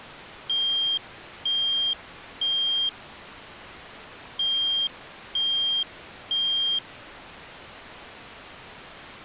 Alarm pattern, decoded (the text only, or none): temporal three